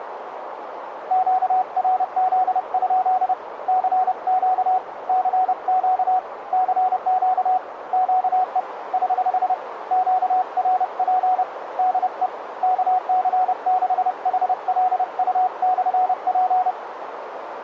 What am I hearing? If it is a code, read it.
Morse code, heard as a keyed tone, hand-sent with a paddle, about 30 wpm, 740 Hz, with radio static and a narrow filter. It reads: QRZ? CQ CQ CQ QE <HH> QRP DE KC6HLU/P